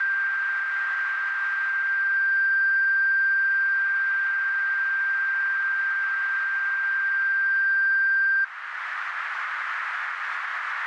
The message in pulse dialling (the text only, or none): none